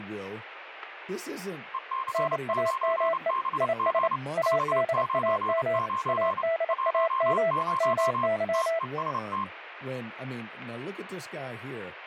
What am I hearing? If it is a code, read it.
Morse code, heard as two keyed tones, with radio static and speech in English. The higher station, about 29 wpm, 1060 Hz: EC9BG 599 10 TEST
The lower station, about 28 wpm, 660 Hz: NAME IS ADAM ADAM MY